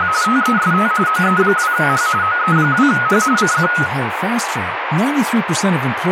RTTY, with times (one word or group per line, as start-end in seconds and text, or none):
0.0-0.1 …
0.2-0.9 TEST
1.1-2.1 OE2H
2.2-3.2 OE2H
3.4-3.7 CQ